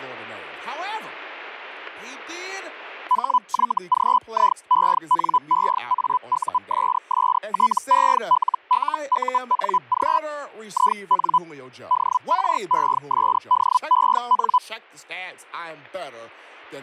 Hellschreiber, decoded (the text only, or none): HYGIENEAUSSTELLUNG IN DRESDEN